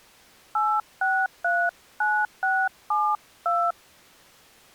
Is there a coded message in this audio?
Yes: DTMF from 0.6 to 3.7 s, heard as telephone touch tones, dialled by hand, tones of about 250 ms. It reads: 8639672